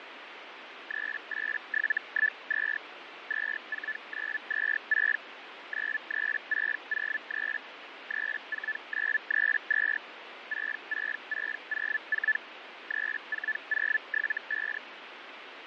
Hellschreiber (Feld-Hell, 122.5 baud), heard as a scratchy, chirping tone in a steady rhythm, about 1750 Hz, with radio static and fading. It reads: 38712 24926 93603 34932 66604 34075